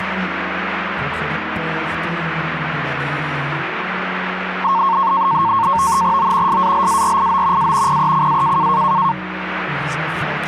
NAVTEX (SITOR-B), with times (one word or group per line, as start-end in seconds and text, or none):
6.2-6.6 O
6.5-7.7 SALARIO
7.6-8.0 A
7.9-8.7 PECA